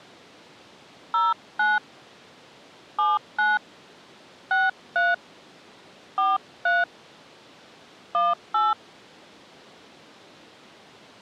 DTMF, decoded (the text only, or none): 09 79 63 43 18